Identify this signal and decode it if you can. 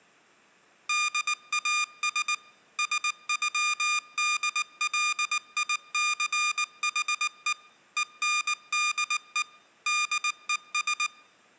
Morse code (with German letters), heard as electronic beeps, machine-sent, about 19 wpm, 1210 Hz, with room echo. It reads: DAS SÜDLICHE ENDE DES